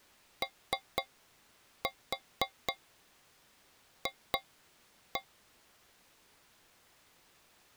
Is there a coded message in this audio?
Yes: tap code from 0.4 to 5.3 s, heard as taps on a metal pipe, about 4 knocks a second. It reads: OF